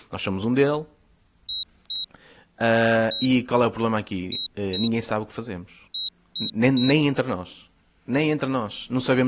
Beep code, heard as a piezo beeper, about 3850 Hz, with speech in Portuguese. 2-1-2-3. In Phoenix BIOS tables: ROM copyright notice check failure.